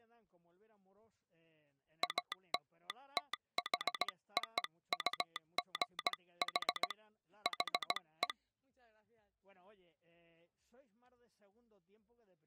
Morse code (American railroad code), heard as a telegraph sounder, hand-sent with a straight key. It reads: ALTHOUGH HE